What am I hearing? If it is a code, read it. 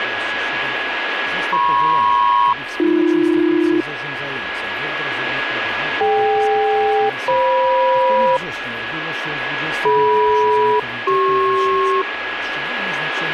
Aircraft SELCAL, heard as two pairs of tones, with radio static and a steady whistle near 1670 Hz. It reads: MP-AB DK-FM DM-CP